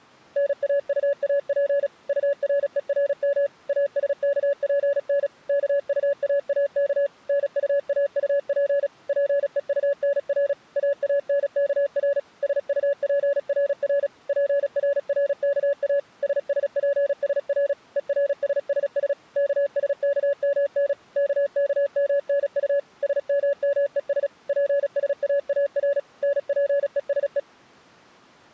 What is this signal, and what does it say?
Morse code, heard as a keyed tone, machine-sent, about 36 wpm, 560 Hz. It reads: NAUAP URERM ASKPN KUAAK NUAUP PEUNR AANKR SUPRR PRRKA SSPSR ERSSS KSKMN KKMNU SMMES PSAAR NPESE